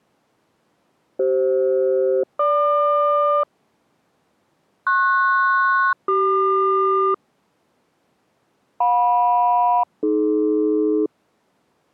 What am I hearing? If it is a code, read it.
Aircraft SELCAL, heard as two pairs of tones. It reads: CF-GQ PS-CQ JM-AD